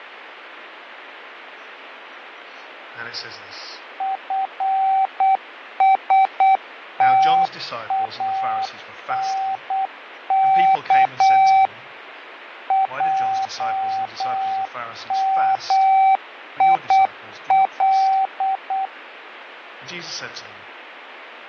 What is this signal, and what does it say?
Morse code (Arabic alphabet), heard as a keyed tone, machine-sent, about 8 wpm, 770 Hz, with radio static and fading. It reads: فستانك جميل